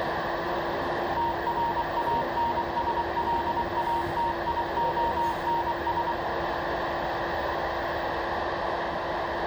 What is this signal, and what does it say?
Morse code, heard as a keyed tone, machine-sent, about 24 wpm, 930 Hz, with radio static, a narrow filter and the noise of a crowd indoors. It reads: TRANSLATIONS